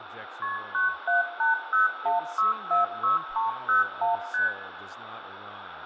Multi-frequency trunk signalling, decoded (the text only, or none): KP 97801646301 ST